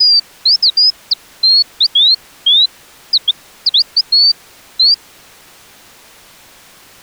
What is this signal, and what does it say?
Bird-like chirps. There is no code.